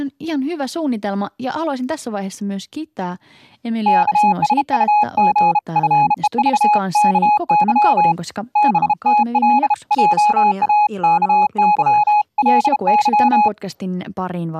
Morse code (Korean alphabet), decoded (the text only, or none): 옛날에 덕호에게